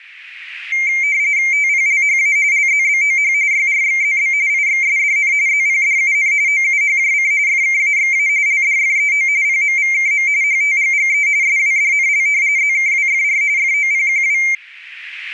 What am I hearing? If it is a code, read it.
RTTY (45.45 baud, 170 Hz shift), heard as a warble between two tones, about 2200 Hz centre. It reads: TPLHA LZBOH YRXZB IXSDN ZPDUN OUHJC FKAXA LDFEO PMVKM HTGGE SWDNL ZKWFR FOPQW